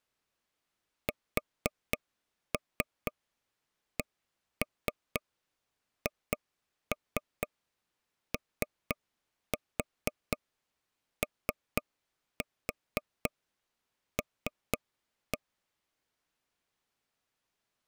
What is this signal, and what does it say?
Tap code, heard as taps on a table, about 4 knocks a second. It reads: SCHOOL